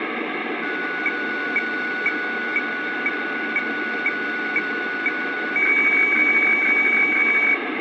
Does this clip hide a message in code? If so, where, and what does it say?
Yes: weather fax (radiofax), 120 lines a minute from 0.6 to 7.5 s, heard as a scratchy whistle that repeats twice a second, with radio static.